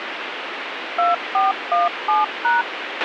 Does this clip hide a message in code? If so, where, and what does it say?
Yes: DTMF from 1.0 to 2.6 s, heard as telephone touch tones, dialled by machine, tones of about 170 ms, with radio hiss and a squelch burst at the end. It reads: 2417#